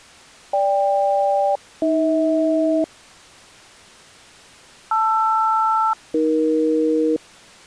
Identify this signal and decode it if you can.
Aircraft SELCAL, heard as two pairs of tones. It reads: GK-AH LR-AE